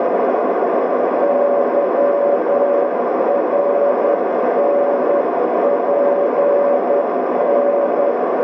Morse code, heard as a keyed tone, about 10 wpm, 570 Hz, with heavy radio static and a narrow filter. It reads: YRNPN